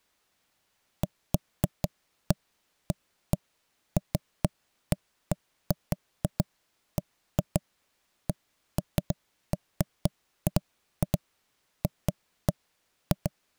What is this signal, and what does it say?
Irregular knocks on wood. There is no code.